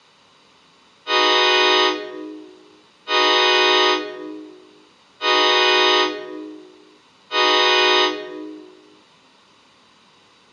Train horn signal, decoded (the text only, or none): 4 short